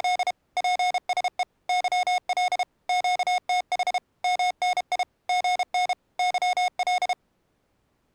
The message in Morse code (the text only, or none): … PSE YL QTH MNI GN YL